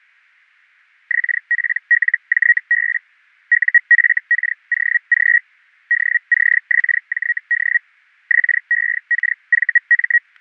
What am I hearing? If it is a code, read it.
Hellschreiber (Feld-Hell, 122.5 baud), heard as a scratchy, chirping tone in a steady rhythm, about 1900 Hz, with static crashes. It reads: XPLJB UFKOG DCXJD XEKVM